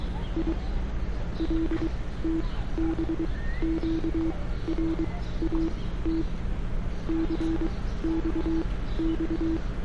Morse code, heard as a keyed tone, machine-sent, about 23 wpm, spaced as for 15 wpm, 320 Hz, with street noise. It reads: I LTBQRAT CXX